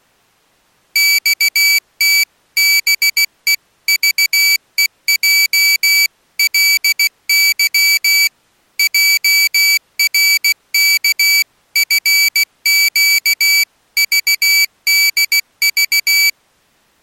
Morse code (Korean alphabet), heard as a high beeper, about 16 wpm, 2300 Hz. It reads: 커다랗게 흉내를